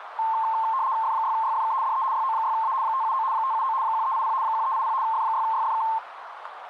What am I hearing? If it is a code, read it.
RTTY (75 baud, 170 Hz shift), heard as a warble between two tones, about 980 Hz centre, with radio static and a narrow filter. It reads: F6YFK DE YO6A 579 579 1380 1380 F6YFK